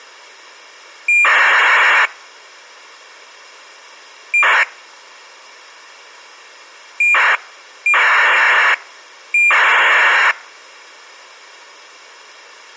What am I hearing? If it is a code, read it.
ACARS aircraft data, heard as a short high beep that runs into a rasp, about 2400 baud.